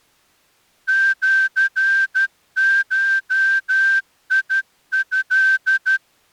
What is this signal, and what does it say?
Morse code (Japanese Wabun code), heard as a whistle, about 12 wpm. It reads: シゴト